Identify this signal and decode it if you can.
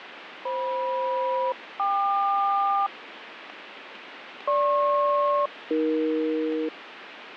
Aircraft SELCAL, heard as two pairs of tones, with radio static. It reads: FM-KQ GP-AE